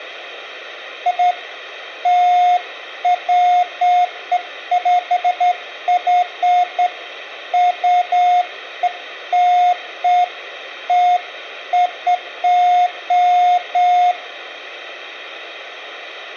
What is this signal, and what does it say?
Beeps of irregular length, with room echo. There is no code.